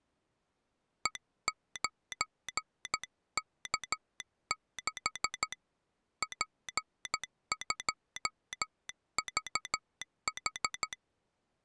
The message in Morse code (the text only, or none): E9K6 P2VH